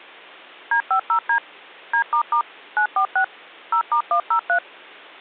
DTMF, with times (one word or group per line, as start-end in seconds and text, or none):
0.7-1.4 D50D
1.9-2.4 D**
2.8-3.2 946
3.7-4.6 0*103